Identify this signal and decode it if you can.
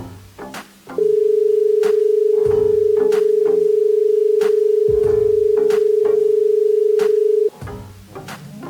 Telephone call progress tone (as in Australia), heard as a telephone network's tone, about 430 Hz. Dial tone.